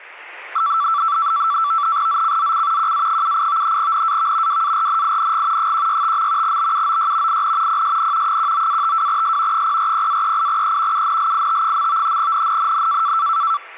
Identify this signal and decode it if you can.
NAVTEX (SITOR-B), 100 baud, 170 Hz shift, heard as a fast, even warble, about 1240 Hz centre. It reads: ZCZC QA78 NAV WARNING 165. BUOY IN PSN 19-52S 040-38E UNLIT. NNNN